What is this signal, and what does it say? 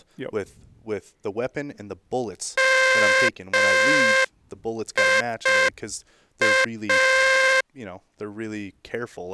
Morse code, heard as a buzzer, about 5 wpm, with speech in English. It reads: MIA